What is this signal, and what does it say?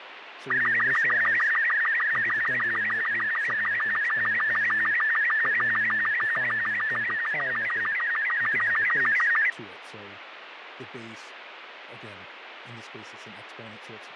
SSTV (slow-scan television), Robot 36, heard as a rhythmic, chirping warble, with radio static and speech in English.